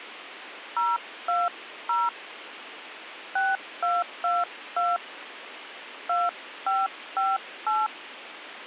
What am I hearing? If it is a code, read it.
DTMF, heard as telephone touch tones, dialled by hand, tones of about 200 ms, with radio hiss. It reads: 020 6222 2558